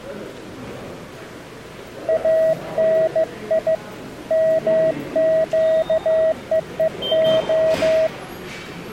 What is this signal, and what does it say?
Morse code (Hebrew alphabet), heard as a keyed tone, hand-sent with a bug key, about 15 wpm, 640 Hz, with the noise of a subway station. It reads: אני מקווה